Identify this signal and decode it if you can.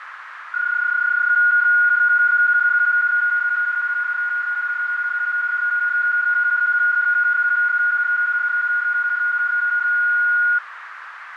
PSK31 (31.25 baud), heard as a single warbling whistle, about 1440 Hz, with radio static and a narrow filter.